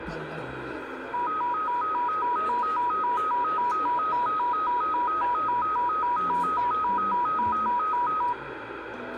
A tone that alternates evenly between two pitches, with radio static, room echo and the noise of a crowd indoors. There is no code.